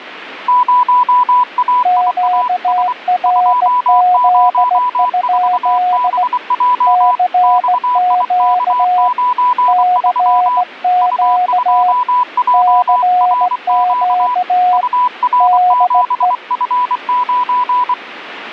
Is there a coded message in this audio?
Yes: Morse code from 0.4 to 18.0 s, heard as two keyed tones. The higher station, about 24 wpm, 990 Hz: 0AIAS 204BJ XIK93 U2JRQ UR7F9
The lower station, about 17 wpm, 720 Hz: QRZ? CQ CQ CQ DE